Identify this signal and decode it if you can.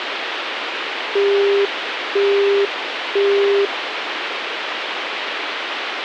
Telephone call progress tone (single-tone plan, as in Europe, Japan and elsewhere), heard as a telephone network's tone, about 400 Hz, 0.5 s on and 0.5 s off, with phone line noise. Busy tone.